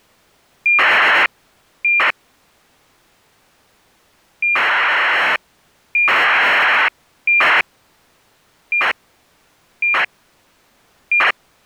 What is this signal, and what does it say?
ACARS aircraft data, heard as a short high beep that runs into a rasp, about 2400 baud.